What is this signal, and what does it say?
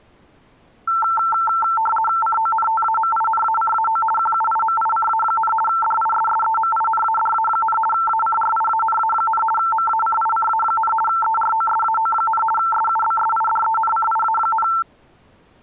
RTTY (50 baud, 450 Hz shift), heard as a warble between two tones, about 1120 Hz centre. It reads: CONTAMINACAO QUIMICA, DISSEMINADA, ACRIANA, MACICA, EROSAO, SUBSIDENCIA,